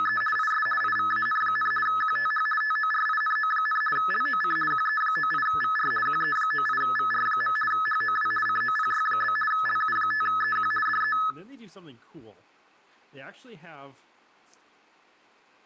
RTTY (50 baud, 450 Hz shift), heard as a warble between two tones, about 1500 Hz centre, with room echo and speech in English. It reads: … IS IVAN, QTH TORINO, LOC QE98VR QE98VR. HOW COPY? LU5EQ DE